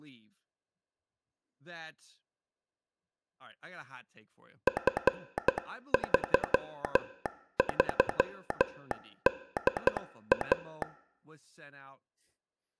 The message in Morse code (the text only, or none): F33DA